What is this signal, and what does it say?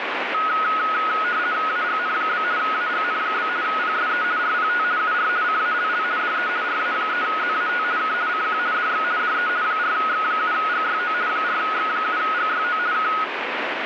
RTTY (50 baud, 170 Hz shift), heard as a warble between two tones, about 1360 Hz centre, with radio static. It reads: AGN? AGN? PSE RPT UR CALL DE RA3ZAT K CQ DX DE 4X7GYO 4X7GYO K